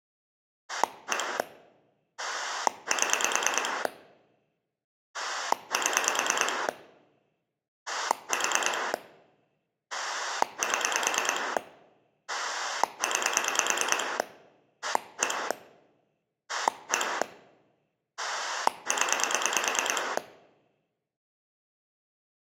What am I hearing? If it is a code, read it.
Pulse dialling, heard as a rotary dial, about 9 pulses a second. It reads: 1 7 7 4 7 9 1 1 0